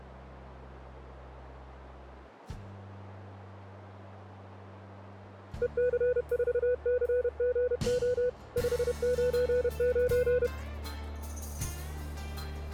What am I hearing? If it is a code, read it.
Morse code, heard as a keyed tone, machine-sent, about 31 wpm, 500 Hz. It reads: EC4CGO 599